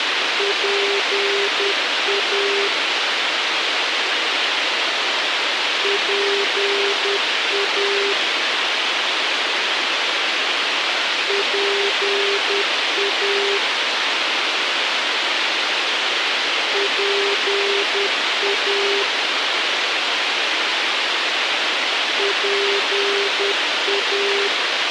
Morse code, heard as a keyed tone, machine-sent, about 10 wpm, 400 Hz, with radio hiss. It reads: PA PA PA PA PA